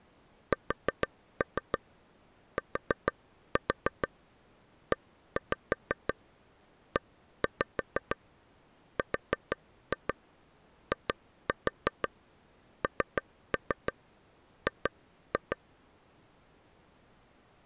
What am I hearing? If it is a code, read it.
Tap code, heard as taps on a table, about 6 knocks a second. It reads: STEERING